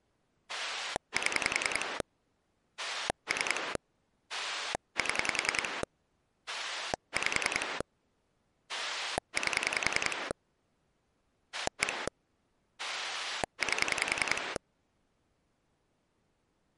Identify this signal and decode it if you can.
Pulse dialling, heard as a rotary dial, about 10 pulses a second. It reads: 7 3 7 5 8 1 8